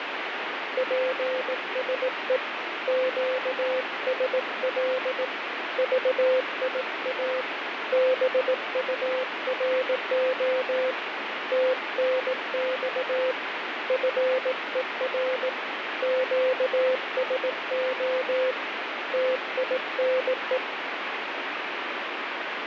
Morse code, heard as a keyed tone, hand-sent with a paddle, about 18 wpm, 520 Hz, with radio static. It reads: PSE QSL VIA BURO TNX FER QSO TINE